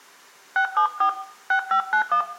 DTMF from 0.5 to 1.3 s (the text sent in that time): 674